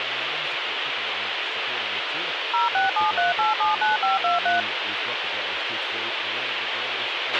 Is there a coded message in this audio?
Yes: DTMF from 2.5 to 4.6 s, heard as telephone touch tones, dialled by machine, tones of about 150 ms, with radio hiss, a squelch burst at the end and speech in English. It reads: 0673879523